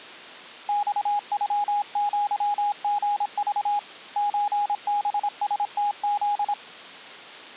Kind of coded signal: Morse code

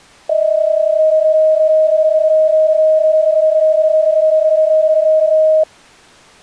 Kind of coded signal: PSK31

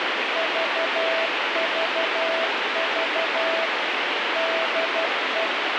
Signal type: Morse code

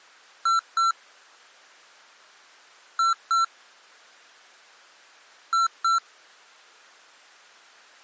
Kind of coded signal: beep code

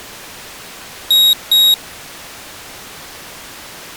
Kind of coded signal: beep code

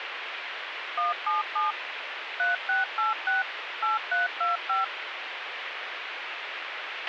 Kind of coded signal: DTMF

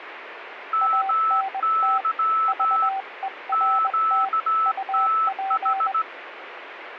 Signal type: Morse code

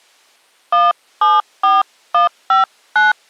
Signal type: DTMF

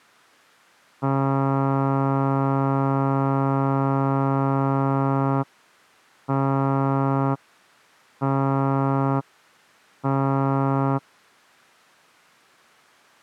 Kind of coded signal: ship horn signal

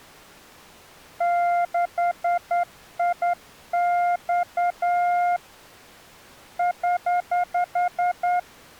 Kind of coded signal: Morse code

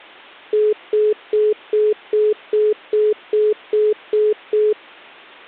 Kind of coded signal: telephone call progress tone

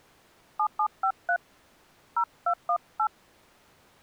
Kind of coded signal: DTMF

